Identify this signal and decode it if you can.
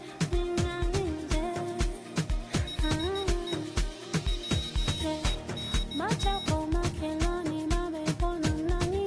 Morse code, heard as a high beeper, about 15 wpm, 3800 Hz. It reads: HE WENT